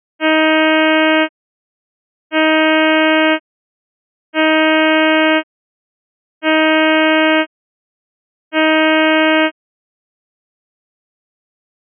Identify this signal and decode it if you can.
Ship horn signal, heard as a ship's horn, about 310 Hz. 5 short. At sea: I doubt that you are doing enough to avoid a collision.